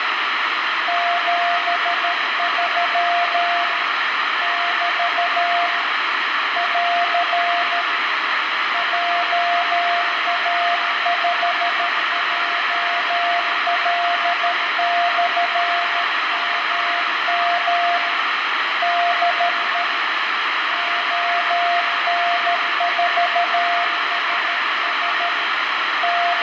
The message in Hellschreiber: none

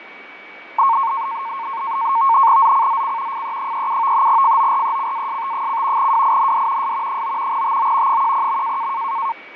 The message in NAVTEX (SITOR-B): ZCZC FE37 FORECAST: WIND S 9 TO 10.

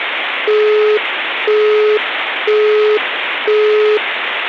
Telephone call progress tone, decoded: busy tone

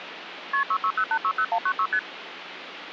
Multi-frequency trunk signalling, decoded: KP 660860196 ST

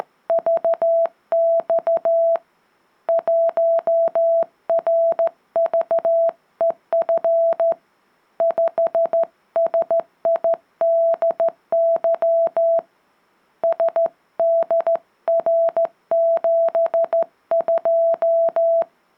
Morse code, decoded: … 1RVEF 5SIDY SDR72

